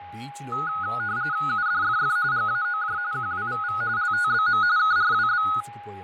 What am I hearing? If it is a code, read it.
RTTY (45.45 baud, 170 Hz shift), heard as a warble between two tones, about 1360 Hz centre, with fading, a steady whistle near 820 Hz and speech in Telugu. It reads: UDFF GAOJ QWVV LTBM KRWB